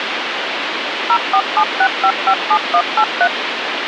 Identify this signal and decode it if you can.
DTMF, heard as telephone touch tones, dialled by machine, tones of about 70 ms, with phone line noise. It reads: 0476557183